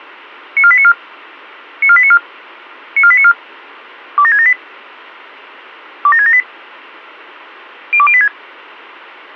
Five-tone selective call (ZVEI), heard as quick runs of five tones, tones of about 70 ms. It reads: 94894 94894 94894 27678 27678 02086